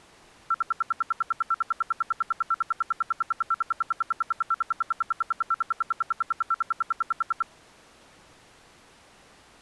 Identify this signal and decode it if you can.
Radio time signal (RWM, Moscow), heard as ten pulses a second.